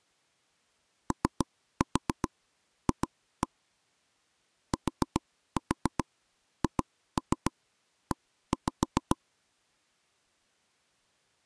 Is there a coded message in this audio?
Yes: tap code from 1.1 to 9.2 s, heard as taps on a table, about 7 knocks a second. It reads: OF THE